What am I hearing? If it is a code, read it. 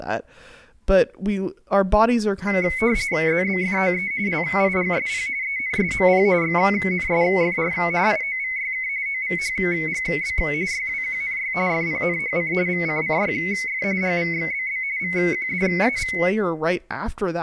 RTTY (45.45 baud, 170 Hz shift), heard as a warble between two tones, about 2150 Hz centre, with speech in English. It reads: ZBFOE LIGSP ENSMP XNSFR IOVYK OVHGB YWQNY FPNHC VCCYF GVXBB VQDAV